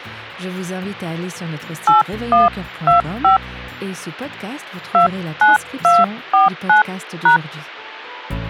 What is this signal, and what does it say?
DTMF, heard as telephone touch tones, dialled by hand, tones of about 150 ms. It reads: 8125 29249#